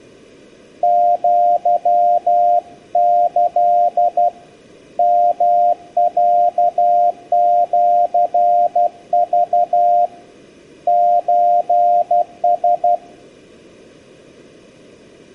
Morse code (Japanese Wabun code), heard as a keyed tone, hand-sent with a paddle, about 12 wpm, 700 Hz. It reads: アキ ヨロシク ソラ